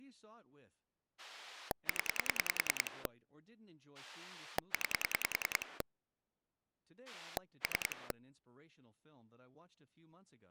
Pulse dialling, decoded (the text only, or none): 0 9 3